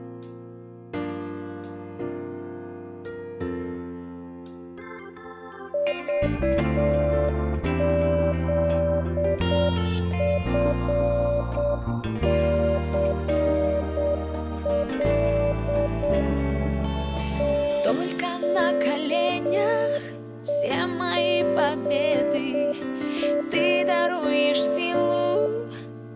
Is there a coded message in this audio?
Yes: Morse code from 5.7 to 25.5 s, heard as a keyed tone, machine-sent, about 7 wpm, 580 Hz, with room echo. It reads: VZFCL TKEGJ